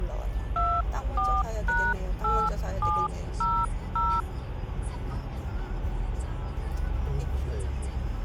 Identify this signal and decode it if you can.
DTMF, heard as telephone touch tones, dialled by hand, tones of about 250 ms, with the noise inside a car. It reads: 24#8700